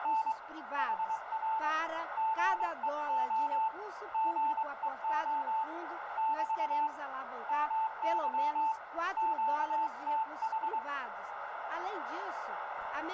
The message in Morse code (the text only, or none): … HR GEO GEO <BT> MY QTH